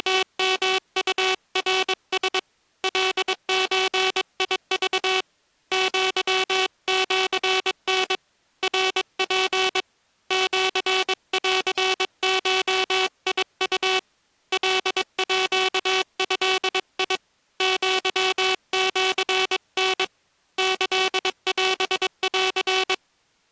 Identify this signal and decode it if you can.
Morse code (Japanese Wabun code), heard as a buzzer, hand-sent with a paddle, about 22 wpm. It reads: … カゾク アシタ ナツ シンゴウ カード アシタ キオン